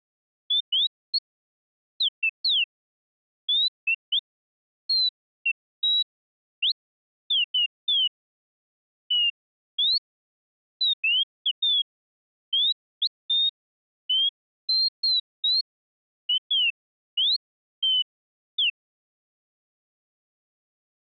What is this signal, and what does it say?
Bird-like chirps. There is no code.